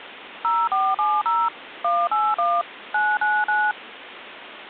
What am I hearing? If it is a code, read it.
DTMF, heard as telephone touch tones, dialled by machine, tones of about 230 ms, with phone line noise. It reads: 0470 181 999